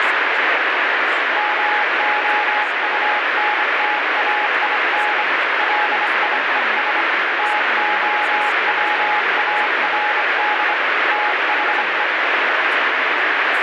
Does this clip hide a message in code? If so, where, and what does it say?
Yes: Morse code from 1.3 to 12.1 s, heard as a keyed tone, hand-sent with a bug key, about 25 wpm, 840 Hz, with heavy radio static and speech in English. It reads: MOUNTAIN LIES TOWARD THE